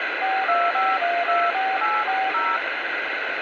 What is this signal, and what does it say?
DTMF, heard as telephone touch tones, dialled by machine, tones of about 220 ms, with radio hiss. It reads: 425124840